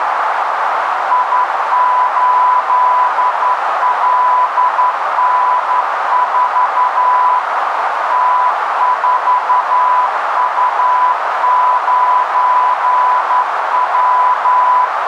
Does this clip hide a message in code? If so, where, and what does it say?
Yes: Morse code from 1.1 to 14.9 s, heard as a keyed tone, hand-sent with a straight key, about 11 wpm, 1000 Hz, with heavy radio static and a narrow filter. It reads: I8LN4 T4U9W